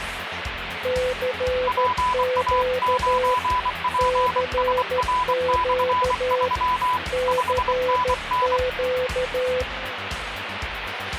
Morse code, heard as two keyed tones, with radio static. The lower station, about 13 wpm, 510 Hz: CQ CQ CQ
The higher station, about 24 wpm, 1000 Hz: PA9PSR/3 5NN